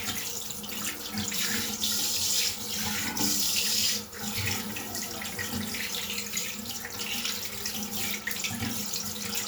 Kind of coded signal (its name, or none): none